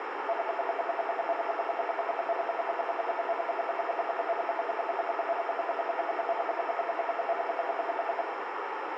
Radio time signal (RWM, Moscow), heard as ten pulses a second, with radio static, a narrow filter and room echo.